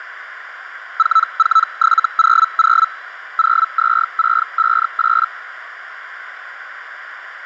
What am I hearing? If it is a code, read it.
Hellschreiber (Feld-Hell, 122.5 baud), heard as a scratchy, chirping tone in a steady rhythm, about 1320 Hz, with radio static. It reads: 44700 02658